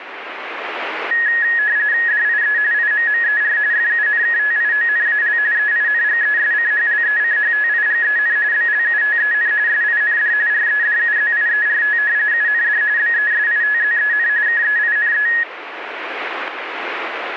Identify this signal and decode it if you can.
RTTY (45.45 baud, 170 Hz shift), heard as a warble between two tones, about 1800 Hz centre, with radio static. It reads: DIE IMMER FUNKTIONAL EINGESCHLECHTIGEN BLUTEN SIND REDUZIERT UND BESITZEN KEINE